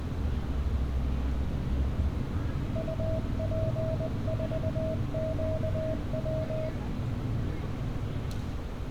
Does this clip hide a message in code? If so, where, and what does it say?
Yes: Morse code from 2.7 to 6.7 s, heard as a keyed tone, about 20 wpm, 640 Hz, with room echo and street noise. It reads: UP4QW